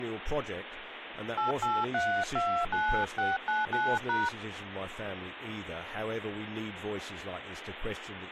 DTMF, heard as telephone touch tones, dialled by hand, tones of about 230 ms, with phone line noise and speech in English. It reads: 88329699#